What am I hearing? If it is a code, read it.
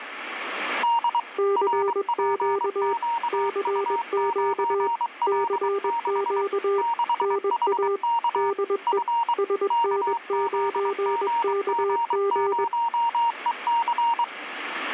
Morse code, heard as two keyed tones, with radio static. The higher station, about 23 wpm, 930 Hz: D RPQU9L6 6HK F KZGG0EC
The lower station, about 21 wpm, 400 Hz: CQ CQ CQ NA DE SN9KG